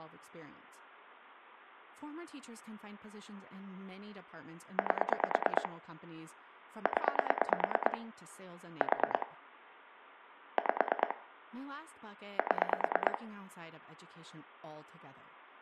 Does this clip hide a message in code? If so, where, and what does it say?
Yes: pulse dialling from 4.8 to 13.2 s, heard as clicks on a phone line, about 9 pulses a second, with room echo and speech in English. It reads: 8 0 4 5 7